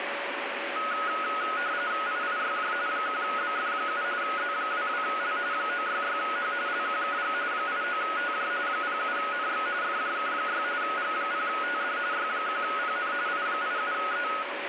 RTTY (45.45 baud, 170 Hz shift), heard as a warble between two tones, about 1360 Hz centre, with radio static and a steady whistle near 570 Hz. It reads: IIYJ 1BF7 Z22L 966H LQKG 89TJ 07NX FJK6 G0TD Y1PN I87E